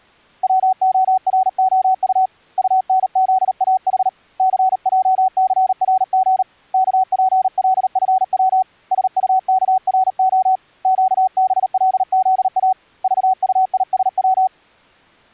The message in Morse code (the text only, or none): WOROU UNZAH CJCRG KPLFW SUKRO QBLZA VUISW